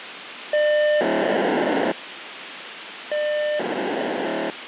POCSAG pager data (1200 baud), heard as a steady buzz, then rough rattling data, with radio hiss.